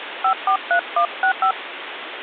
DTMF, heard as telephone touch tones, dialled by hand, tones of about 90 ms, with phone line noise. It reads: 543165